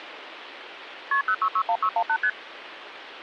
Multi-frequency trunk signalling (R1, as on North American trunks), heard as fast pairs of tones, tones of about 70 ms, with phone line noise. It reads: KP 0661618 ST